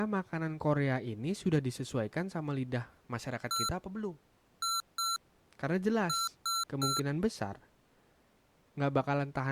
Beep code, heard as beeps from a small speaker, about 1350 Hz, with speech in Indonesian. 1-2-3. In Phoenix BIOS tables: DMA page register failure.